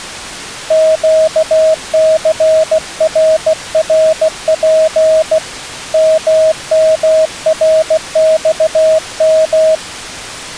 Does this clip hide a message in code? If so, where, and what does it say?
Yes: Morse code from 0.6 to 9.8 s, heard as a keyed tone, hand-sent with a bug key, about 16 wpm, 630 Hz. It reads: QCRRP MMRXM